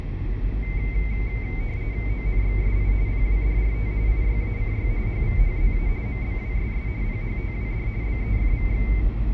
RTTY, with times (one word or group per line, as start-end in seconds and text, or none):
2.1-2.9 ONXSI
3.1-3.9 PWDRT
4.1-4.9 IYACY
5.1-5.9 HVHZA
6.1-6.9 MBWSS
7.0-7.9 PHTWD
8.0-8.9 BEFVX